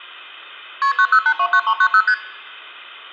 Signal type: multi-frequency trunk signalling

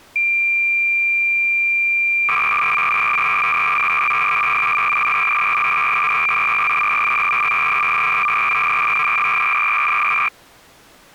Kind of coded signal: cassette data (Kansas City type)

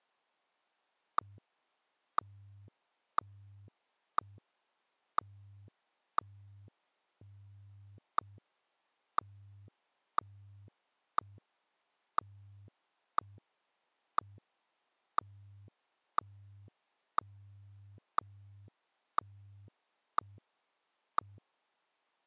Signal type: radio time signal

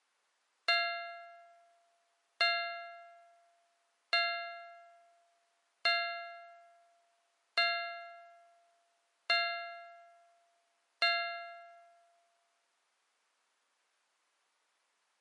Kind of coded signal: clock strike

